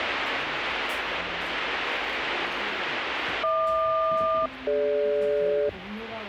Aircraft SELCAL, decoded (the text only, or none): HQ-DG